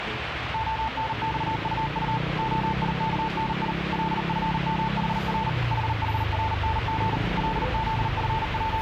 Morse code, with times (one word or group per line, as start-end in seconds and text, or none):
0.5-2.2 ONXUU
2.4-3.7 OIKNI
3.9-5.5 LFMHR
5.7-7.2 HHRNG
7.4-8.8 …